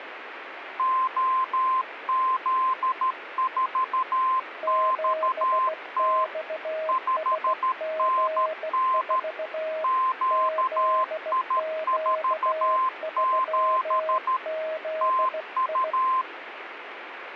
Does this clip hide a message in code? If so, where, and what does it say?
Yes: Morse code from 0.7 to 16.3 s, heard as two keyed tones, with radio static. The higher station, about 13 wpm, 1040 Hz: OZ4XT 5NN QI47 TU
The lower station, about 16 wpm, 630 Hz: 7XSG4 ZQ3ZI